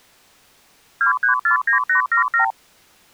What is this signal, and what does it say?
Multi-frequency trunk signalling (R2, with the far end's replies), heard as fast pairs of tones, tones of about 110 ms. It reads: 2349877